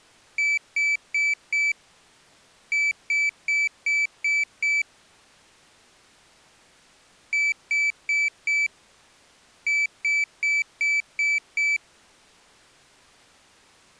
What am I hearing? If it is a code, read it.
Beep code, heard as a piezo beeper, played twice, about 2300 Hz. 4-6.